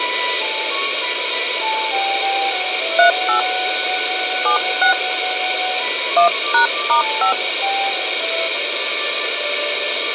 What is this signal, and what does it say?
DTMF, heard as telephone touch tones, dialled by hand, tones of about 110 ms, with radio hiss. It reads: 38 76 1#*5